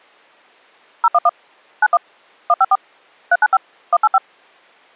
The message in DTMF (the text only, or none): 011 91 154 395 185